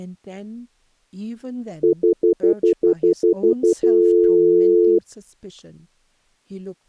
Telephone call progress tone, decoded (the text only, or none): stutter dial tone